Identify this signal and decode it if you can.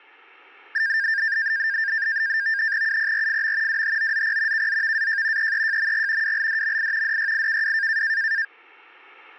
NAVTEX (SITOR-B), 100 baud, 170 Hz shift, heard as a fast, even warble, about 1700 Hz centre. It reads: UPRFM WHOZP KZVAJ EEJMG WLDMI DYIKW